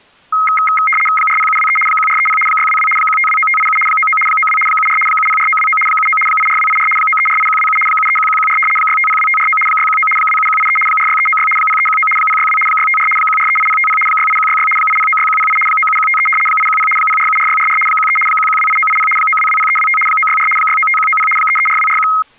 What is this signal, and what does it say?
RTTY (75 baud, 850 Hz shift), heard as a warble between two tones, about 1700 Hz centre. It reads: 40723 1430 622 1529587 99 92 74 704929 79 84284 9348127 731114 6502549 619 27183 46396 0319 062 654 1438050 68166 8096108 97153 810 0474644 13 1128980 9220325 964 695190 334241